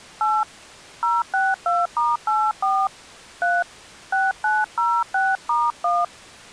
DTMF, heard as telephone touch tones, dialled by hand, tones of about 220 ms. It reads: 8 062*84 3 6906*1